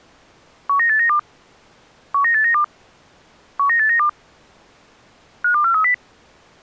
Five-tone selective call (CCIR), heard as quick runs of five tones, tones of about 100 ms. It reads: 19892 19892 19892 52430